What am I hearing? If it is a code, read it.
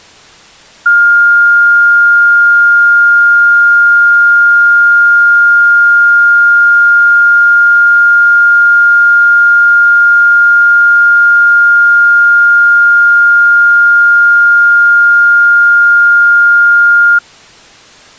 A steady tone. There is no code.